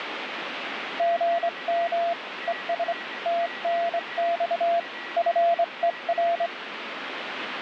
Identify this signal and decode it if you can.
Morse code, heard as a keyed tone, hand-sent with a straight key, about 24 wpm, 680 Hz, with radio static and a weaker station near 1930 Hz. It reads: GM ES TNX FER